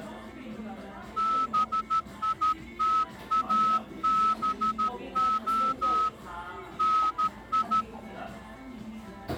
Morse code, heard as a whistle, hand-sent with a straight key, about 13 wpm, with the noise of a cafe. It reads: BITABO NI